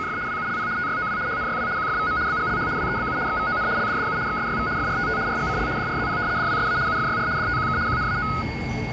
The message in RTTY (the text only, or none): … WULP TYOW HNYW QFVM BGLH WEBU XVON LDDU XSYV FRTT RGCL DRZP DWSA UFYR DTQK QNAO